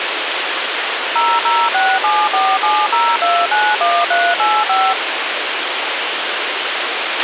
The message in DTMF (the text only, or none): 0067470291385